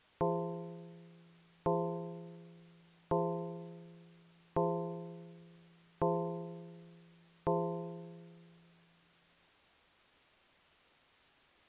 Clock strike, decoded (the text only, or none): 6